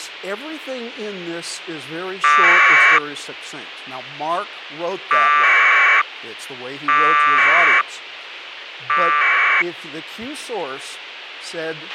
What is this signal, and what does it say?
Packet radio (AX.25, as in APRS), 1200 baud, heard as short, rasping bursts, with radio hiss and a squelch burst at the end.